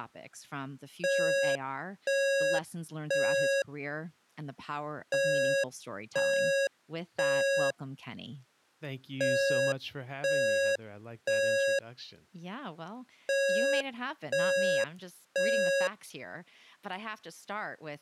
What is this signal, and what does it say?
Alarm pattern, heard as an alarm's beeps, played four times, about 550 Hz, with speech in English. Temporal three. Smoke or fire, evacuate.